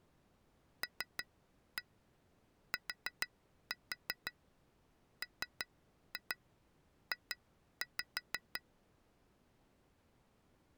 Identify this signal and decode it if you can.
Tap code, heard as taps on glass, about 6 knocks a second. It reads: LTMJ